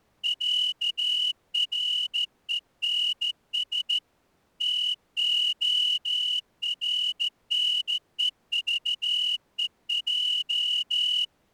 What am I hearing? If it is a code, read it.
Morse code (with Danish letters), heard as a whistle, hand-sent with a straight key, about 14 wpm. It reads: ÆRENS TORNEVEJ